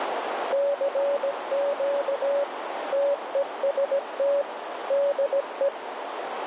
Morse code, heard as a keyed tone, machine-sent, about 17 wpm, 570 Hz, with radio static and a narrow filter. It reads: CQ TEST DE